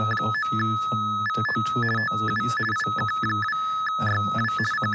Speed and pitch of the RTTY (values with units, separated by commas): 50 baud, 450 Hz shift, 1500 Hz centre